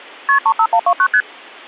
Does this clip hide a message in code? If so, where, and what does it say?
Yes: multi-frequency trunk signalling (R1, as on North American trunks) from 0.3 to 1.2 s, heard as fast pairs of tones, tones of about 70 ms. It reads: KP 35129 ST